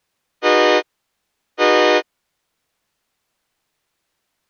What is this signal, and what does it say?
Train horn signal, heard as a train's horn. 2 short. On North American railways: a signal is acknowledged.